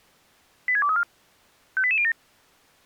Five-tone selective call (ZVEI), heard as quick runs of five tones, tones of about 70 ms. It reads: 86234 58807